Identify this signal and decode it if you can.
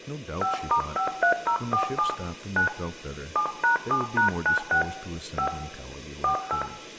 DTMF, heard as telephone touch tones, dialled by hand, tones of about 110 ms, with room echo and speech in English. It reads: 5*53047 9 7#7#96 5 48